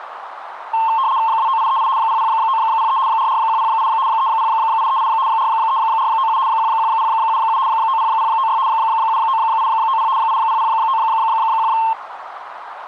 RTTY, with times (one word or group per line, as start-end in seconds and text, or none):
1.3-1.9 29838
2.0-3.0 00903
3.1-3.9 44108
4.1-5.1 30838
5.3-6.4 43497
6.5-7.6 11077
7.7-8.6 90096
8.7-10.1 79890
10.2-11.7 80091